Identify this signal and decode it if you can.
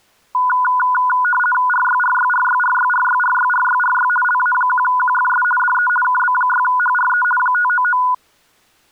RTTY (50 baud, 450 Hz shift), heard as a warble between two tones, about 1230 Hz centre. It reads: RYRYRYRYRYRYRYRY LA1QFS DE KB6HRE 599